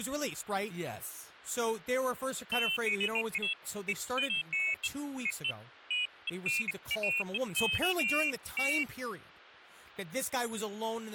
Pairs of high tones at irregular times, with speech in English. There is no code.